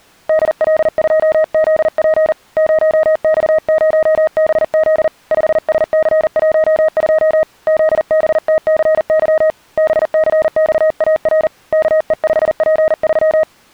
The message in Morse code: DL2ZP 0X0BZ 5SC12 ZBTCY BCXAR KE5P3

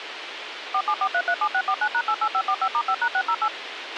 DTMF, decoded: 474337649#88545*5#608

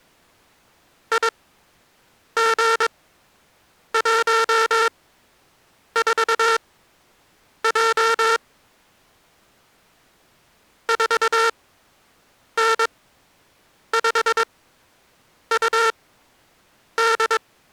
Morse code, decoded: IG14J 4N5UD

